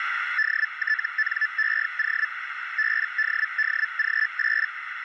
Hellschreiber (Feld-Hell, 122.5 baud), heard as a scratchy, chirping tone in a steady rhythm, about 1750 Hz, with radio static and a narrow filter. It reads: DTNEO BDDG8